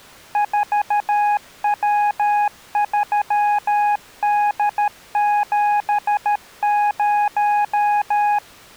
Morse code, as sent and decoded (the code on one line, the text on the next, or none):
....- .-- ...-- -.. --... -----
4W3D70